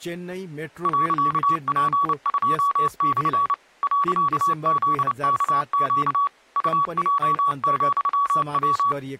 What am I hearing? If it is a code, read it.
Morse code, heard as a keyed tone, machine-sent, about 29 wpm, 1130 Hz, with speech in Nepali. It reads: .P2/ .ZKQ UJ,W